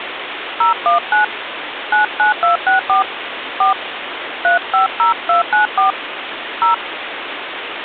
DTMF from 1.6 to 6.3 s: 99264 4 350294

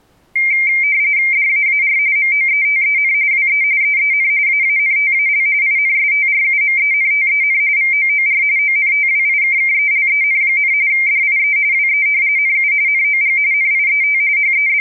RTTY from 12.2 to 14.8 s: NU NOG NIET …

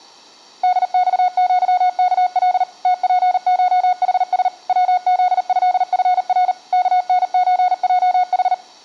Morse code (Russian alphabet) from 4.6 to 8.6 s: ВЗЭФР КНЧЙХ

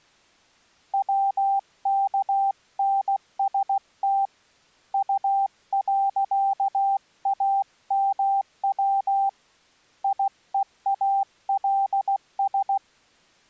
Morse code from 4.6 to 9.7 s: U.AMW

